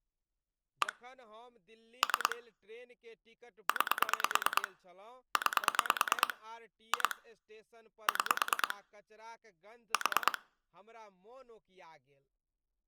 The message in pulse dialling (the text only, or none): 1 3 9 9 2 6 4